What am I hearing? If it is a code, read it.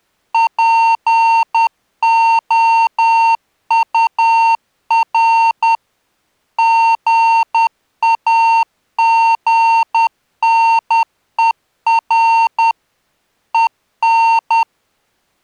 Morse code, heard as electronic beeps, machine-sent, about 10 wpm, 910 Hz. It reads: POUR GAGNER EN